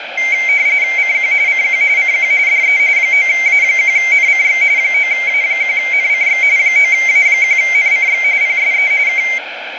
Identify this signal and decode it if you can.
RTTY (45.45 baud, 170 Hz shift), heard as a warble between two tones, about 2200 Hz centre, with radio static. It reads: CQ CQ CQ DE 9A1NCX 9A1NCX 9A1NCX PSE K